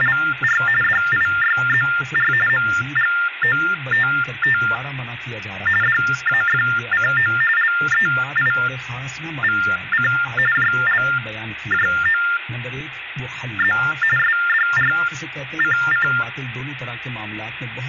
TTY/TDD text telephone tones (45.45 baud Baudot), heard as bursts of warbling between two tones, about 400 Hz shift, 1600 Hz centre, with phone line noise. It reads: … DIYZR MGOTT DAFCO LEIVC JLJOZ SDRCC